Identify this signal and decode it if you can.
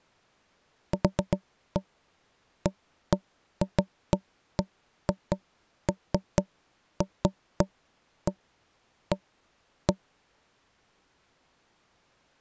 Irregular knocks on wood. There is no code.